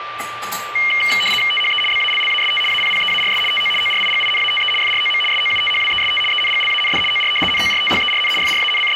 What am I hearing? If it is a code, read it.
RTTY (75 baud, 850 Hz shift), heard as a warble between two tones, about 2550 Hz centre, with radio static, a steady whistle near 1180 Hz and kitchen noise. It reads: THE BALLAST APPEARS TO ORIGINATE FROM SOUTHWEST ENGLAND OR NORTHERN …